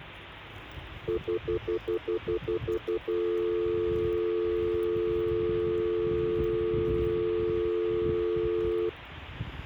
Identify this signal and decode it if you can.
Telephone call progress tone (North American plan), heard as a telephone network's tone, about 350, 440 Hz, 0.1 s on and 0.1 s off, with street noise. Stutter dial tone.